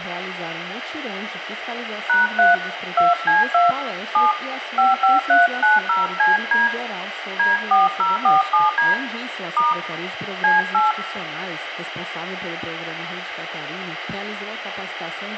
DTMF, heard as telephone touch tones, dialled by hand, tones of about 160 ms, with radio hiss and room echo. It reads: #3 2C2 7 55390CD D4047D * C8